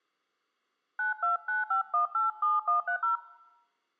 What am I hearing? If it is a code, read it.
DTMF, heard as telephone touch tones, dialled by hand, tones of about 120 ms. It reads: 9295187130